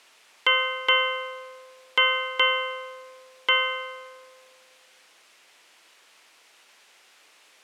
Ship's bell, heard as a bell. 5. Five half-hours of the watch have passed.